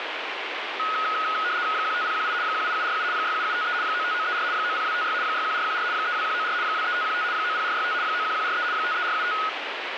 RTTY (75 baud, 170 Hz shift), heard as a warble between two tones, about 1360 Hz centre, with radio static. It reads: 15018 18747 67753 95934 90256 61414 32194 23515 90465 91143 53475